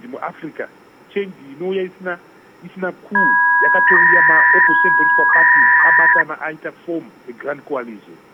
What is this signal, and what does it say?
300-baud modem data (V.21 tones), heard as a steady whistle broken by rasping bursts, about 300 baud, 200 Hz shift.